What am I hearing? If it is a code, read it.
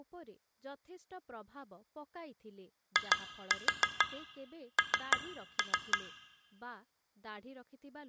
Tap code, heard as taps on glass, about 6 knocks a second, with room echo and speech in Odia. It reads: IN